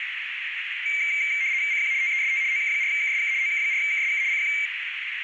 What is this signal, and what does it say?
RTTY (75 baud, 170 Hz shift), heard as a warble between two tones, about 2200 Hz centre, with radio static and a narrow filter. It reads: CQ TEST OK4KSK OK4KSK CQ